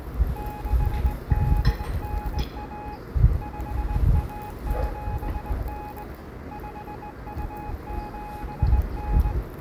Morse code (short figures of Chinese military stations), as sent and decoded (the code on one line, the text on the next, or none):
-.... -.. -. .- / ..... .- --... -. / ..... ..- --... -.
6891 5179 5279